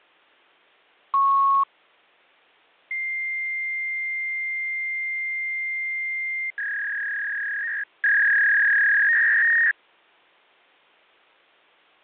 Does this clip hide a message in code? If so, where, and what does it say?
Yes: fax machine handshake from 1.1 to 9.7 s, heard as a beep, a long tone and a warble.